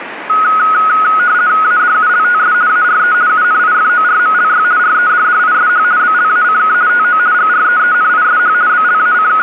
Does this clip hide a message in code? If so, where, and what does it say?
Yes: RTTY (50 baud, 170 Hz shift) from 0.3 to 9.4 s, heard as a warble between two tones, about 1360 Hz centre, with radio static. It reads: ADULTS ARE UNIFORMLY REDDISH BLACK TO GREENISH …